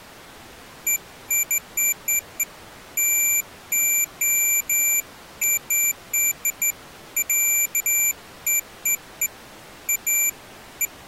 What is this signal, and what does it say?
Beeps of irregular length. There is no code.